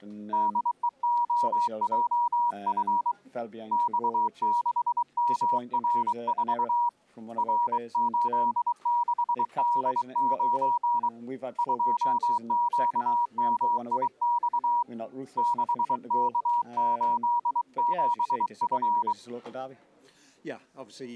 Morse code, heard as a keyed tone, hand-sent with a bug key, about 23 wpm, 960 Hz. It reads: DEOJF X6MR4 R86D9 2QMIX 6K87F